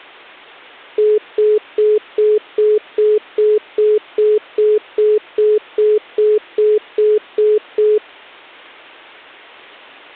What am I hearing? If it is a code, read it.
Telephone call progress tone (single-tone plan, as in most of Europe), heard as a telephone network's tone, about 420 Hz, 0.2 s on and 0.2 s off. Congestion tone.